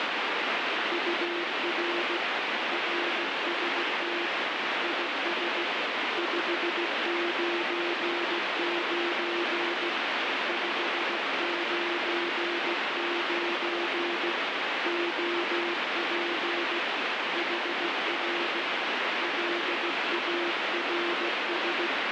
Morse code, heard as a keyed tone, hand-sent with a straight key, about 16 wpm, 350 Hz, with heavy radio static. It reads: UR RST IS 599 599 OP HR LARS